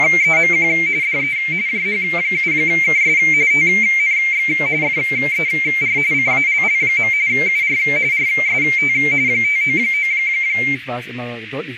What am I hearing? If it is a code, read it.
RTTY (45.45 baud, 170 Hz shift), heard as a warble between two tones, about 2200 Hz centre, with radio static, a narrow filter and speech in German. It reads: … DE JH7KS TNX FER CALL. UR RST 599